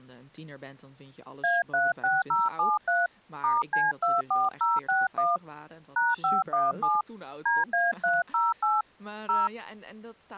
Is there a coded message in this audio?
Yes: DTMF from 1.4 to 9.5 s, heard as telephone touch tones, dialled by hand, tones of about 190 ms, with speech in Dutch. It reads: A36073 *C24061 #517 DA308 0